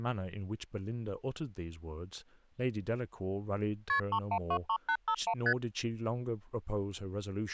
Multi-frequency trunk signalling (R1, as on North American trunks), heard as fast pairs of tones, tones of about 70 ms, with speech in English. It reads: KP 3123851 ST